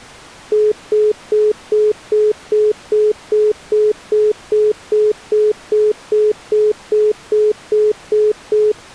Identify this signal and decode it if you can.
Telephone call progress tone (single-tone plan, as in most of Europe), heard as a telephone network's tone, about 420 Hz, 0.2 s on and 0.2 s off. Congestion tone.